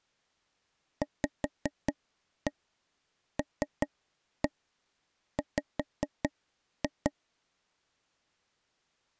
Tap code, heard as taps on a table, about 5 knocks a second. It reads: VLW